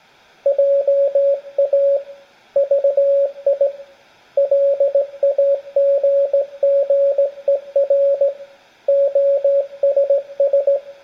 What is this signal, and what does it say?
Morse code, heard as a keyed tone, hand-sent with a straight key, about 17 wpm, 560 Hz, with room echo. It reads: JA VI LAGGER OSS